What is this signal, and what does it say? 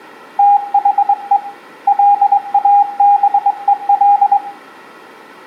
Morse code, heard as a keyed tone, hand-sent with a straight key, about 22 wpm, 810 Hz, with room echo. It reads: THE LABEL